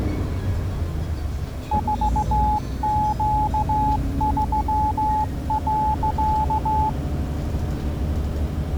Morse code, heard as a keyed tone, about 15 wpm, 860 Hz, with the noise inside a bus. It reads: 4Q3.